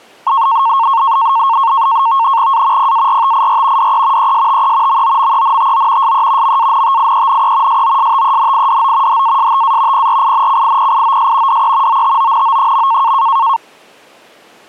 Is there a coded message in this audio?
Yes: NAVTEX (SITOR-B), 100 baud, 170 Hz shift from 0.3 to 13.6 s, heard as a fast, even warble, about 1000 Hz centre. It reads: A PARTIR DE ESTE MOMENTO SE MANTIENE SOSTENIDO HASTA PRINCIPIOS DE OTONO.